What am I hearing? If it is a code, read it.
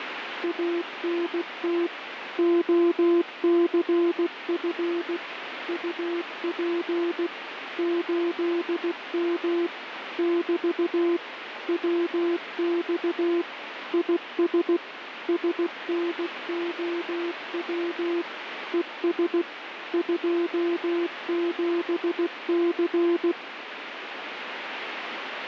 Morse code, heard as a keyed tone, machine-sent, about 16 wpm, 340 Hz, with radio static. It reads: ANT OCF UP 8M <BT> WX IS SNOW ES 27C